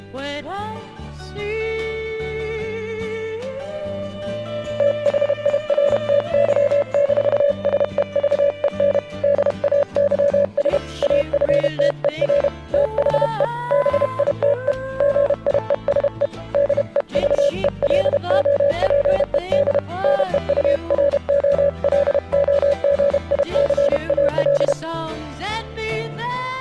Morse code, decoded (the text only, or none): THIRTY-SEVEN DAYS AFTER THE BITE GIESE DEVELOPED NEUROLOGICAL